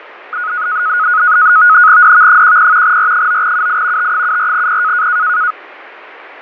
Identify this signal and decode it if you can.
NAVTEX (SITOR-B), 100 baud, 170 Hz shift, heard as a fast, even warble, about 1360 Hz centre, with radio static and fading. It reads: DV10 R9UI T74P